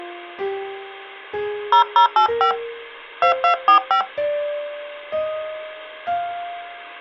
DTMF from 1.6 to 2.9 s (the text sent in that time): 0085